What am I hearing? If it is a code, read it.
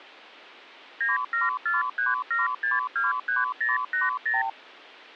Multi-frequency trunk signalling (R2, with the far end's replies), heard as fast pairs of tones, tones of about 160 ms. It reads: 97437623080